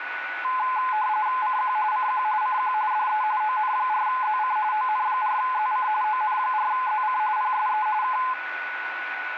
RTTY (45.45 baud, 170 Hz shift), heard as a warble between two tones, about 940 Hz centre, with radio static and a steady whistle near 1480 Hz. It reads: CQ CQ CQ DE ON4ZC ON4ZC ON4ZC PSE K